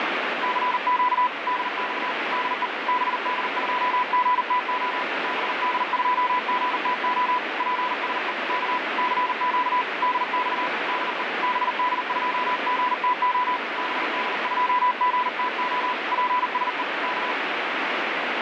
Morse code, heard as a keyed tone, hand-sent with a paddle, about 40 wpm, 990 Hz, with heavy radio static. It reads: CQ DX DE BD2GTO BD2GTO PSE K CQ DX DE BD2GTO BD2GTO PSE K